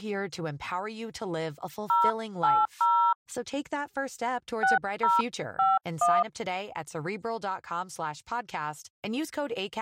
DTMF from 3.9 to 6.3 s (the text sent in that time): 6051